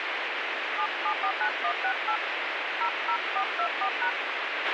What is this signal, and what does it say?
DTMF, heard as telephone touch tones, dialled by hand, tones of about 80 ms, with radio hiss and a squelch burst at the end. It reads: 7749168 00424#